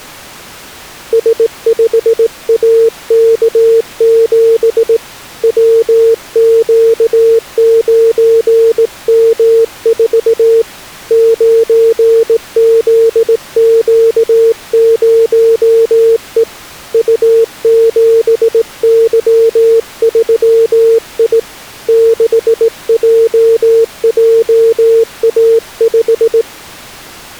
Morse code, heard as a keyed tone, hand-sent with a straight key, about 18 wpm, 450 Hz. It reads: S5AK7 WQ9M4 9ZQ0E U7Y3I 6JJA5